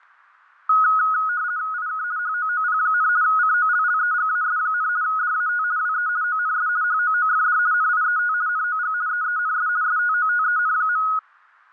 RTTY (50 baud, 170 Hz shift), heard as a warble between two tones, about 1360 Hz centre, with fading. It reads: IK HOOP, COLLEGAS, DAT WE ONS HOOFD NIET NOG EENS STOTEN.